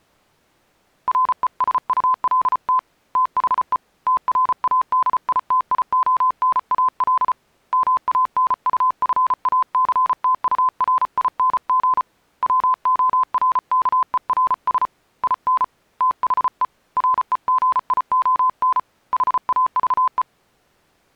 Morse code, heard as a keyed tone, hand-sent with a paddle, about 34 wpm, 1020 Hz. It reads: RESULT THE TRADITIONAL MANUFACTURING WORKERS IN THE REGION HAVE